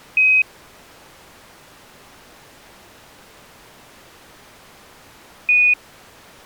Quindar tones, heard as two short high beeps.